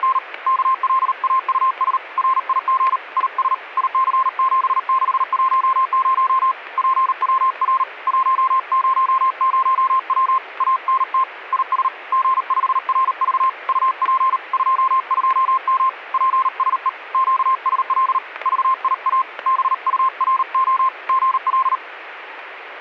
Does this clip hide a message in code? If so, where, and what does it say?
Yes: Morse code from 0.0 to 21.8 s, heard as a keyed tone, hand-sent with a paddle, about 38 wpm, 1050 Hz, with static crashes. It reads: … KLAUS RIG IS IC7610 PWR 100W ANT IS G5RV UP 22M PSE QSL VIA BURO GL